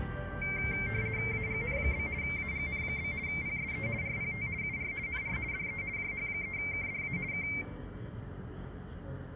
RTTY (50 baud, 170 Hz shift), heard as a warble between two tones, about 2200 Hz centre, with the noise of a park. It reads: AGN? AGN? PSE RPT UR NR DE JH3KDA K